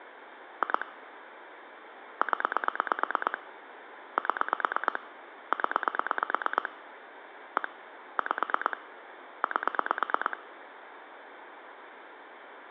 Pulse dialling, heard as clicks on a phone line, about 8 pulses a second, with phone line noise. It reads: 2 0 7 0 1 5 8